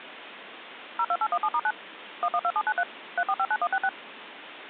DTMF, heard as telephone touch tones, dialled by machine, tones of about 60 ms, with phone line noise. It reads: 02817*9 112793 3459166